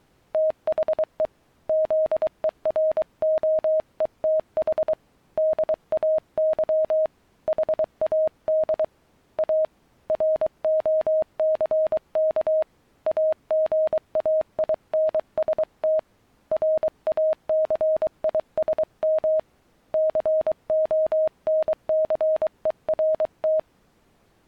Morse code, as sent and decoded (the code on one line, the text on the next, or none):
- .... . / --.. . .-. --- . - .... / -.. .- -.-- / .... .- -.. / .- / .-. --- -.-. -.- / .- --. .- .. -. ... - / .-. .- -.-. .. ... -- / -.-. --- -. -.-. . .-. -
THE ZEROETH DAY HAD A ROCK AGAINST RACISM CONCERT